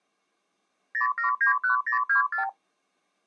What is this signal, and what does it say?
Multi-frequency trunk signalling (R2, with the far end's replies), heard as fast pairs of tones, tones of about 120 ms. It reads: 0791024